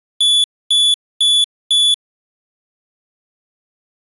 Beep code, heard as a piezo beeper, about 3450 Hz. 4 short. In AMI BIOS tables: system timer failure; in Dell tables: memory read or write failure.